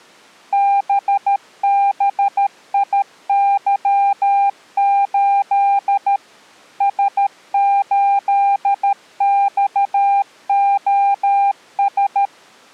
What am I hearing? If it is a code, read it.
Morse code, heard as a keyed tone, machine-sent, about 13 wpm, 800 Hz. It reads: BBIY8 S8XOS